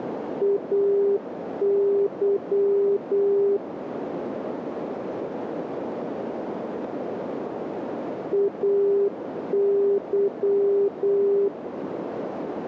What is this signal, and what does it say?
Morse code, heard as a keyed tone, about 8 wpm, 400 Hz, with radio static and a narrow filter. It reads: AY AY